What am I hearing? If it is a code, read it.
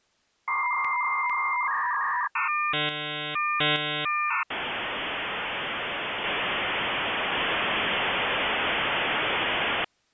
Dial-up modem handshake (V.34 or later), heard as a whistle, warbles, then hiss.